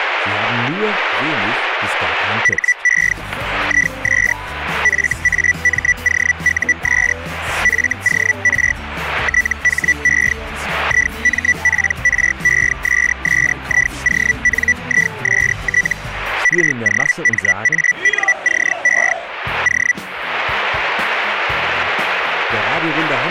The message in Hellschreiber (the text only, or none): HE IS FAMOUS FOR THE IMPRESSIONIST ROMANCE O